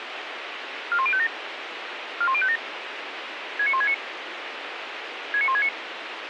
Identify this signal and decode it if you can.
Five-tone selective call (ZVEI), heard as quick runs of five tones, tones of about 70 ms, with radio hiss. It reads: 41057 41057 69169 69169